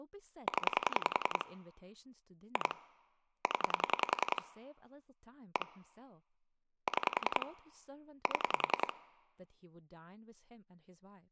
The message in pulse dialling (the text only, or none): 0 2 0 1 6 7